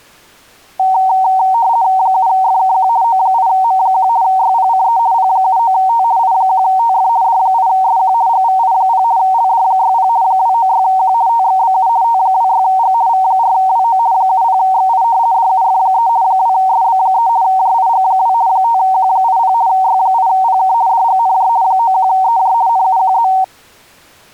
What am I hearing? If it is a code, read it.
RTTY (50 baud, 170 Hz shift), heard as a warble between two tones, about 840 Hz centre. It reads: 7FKQ O8M1 YPCE P79T I1TF D8SQ GVI0 LD60 296Q TXBU T26G V4WO 70XI DUF3 2SB3 JIG2 5Q80 Y8PK DGNJ 91EJ NUQZ